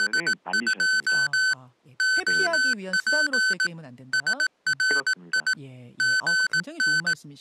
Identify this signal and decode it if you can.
Morse code, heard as electronic beeps, machine-sent, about 18 wpm, 1500 Hz, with speech in Korean. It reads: … OP SRI GN